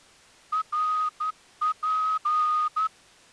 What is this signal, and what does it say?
Morse code (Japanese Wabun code), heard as a whistle, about 12 wpm. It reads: ナツ